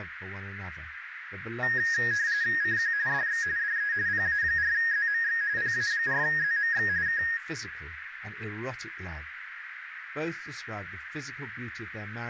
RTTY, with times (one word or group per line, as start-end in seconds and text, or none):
2.6-2.9 CQ
3.1-3.4 DX
3.6-3.9 DE
4.1-5.4 PA4ZMX
5.6-6.9 PA4ZMX
7.1-7.2 K